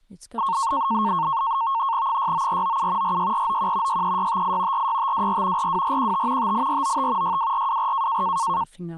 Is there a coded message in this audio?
Yes: NAVTEX (SITOR-B), 100 baud, 170 Hz shift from 0.4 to 8.6 s, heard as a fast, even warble, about 1000 Hz centre, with speech in English. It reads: 69497 46491 63658 46524 42415 58495 62424